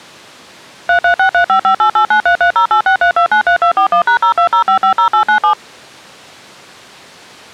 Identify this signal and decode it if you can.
DTMF, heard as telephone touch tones, dialled by machine, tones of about 100 ms. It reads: 336355889330863293241#020550897